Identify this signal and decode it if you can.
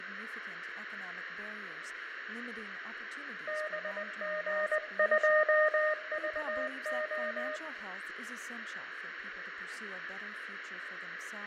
Morse code, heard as a keyed tone, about 20 wpm, 610 Hz, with radio static, fading, room echo and speech in English. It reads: BG2VO